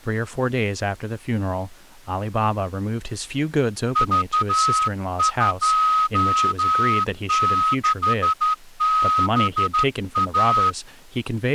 Morse code, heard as a whistle, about 12 wpm, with speech in English. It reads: V26BA